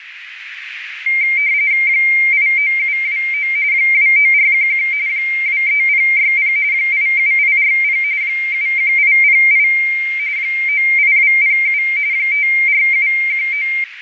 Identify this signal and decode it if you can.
RTTY (45.45 baud, 170 Hz shift), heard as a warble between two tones, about 2200 Hz centre, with radio static and a narrow filter. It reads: 89729 29411 23060 87840 71808 98207 54719